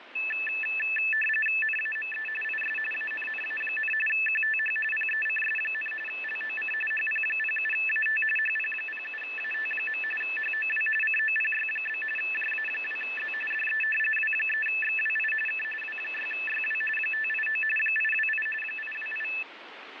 RTTY (45.45 baud, 850 Hz shift), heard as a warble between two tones, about 2200 Hz centre, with radio static. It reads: NAME IS ANNA, QTH PECS, LOC HP07AT HP07AT. HOW COPY? JA2Z DE W3XWI K W6YW 589 828 828